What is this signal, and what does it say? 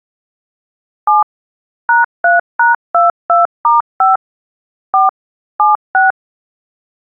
DTMF, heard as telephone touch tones, dialled by machine, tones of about 150 ms. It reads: 7 #3#22*5 4 76